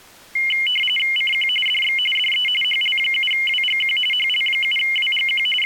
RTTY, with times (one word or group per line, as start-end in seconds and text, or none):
1.2-1.5 CQ
1.7-2.0 DX
2.2-2.5 DE
2.6-4.0 HL7WGQ
4.1-5.5 HL7WGQ
5.6-5.7 …